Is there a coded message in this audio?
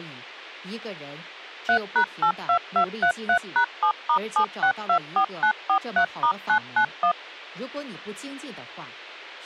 Yes: DTMF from 1.7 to 7.1 s, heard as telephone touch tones, dialled by machine, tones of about 90 ms. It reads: 3#82233#7*7624943*991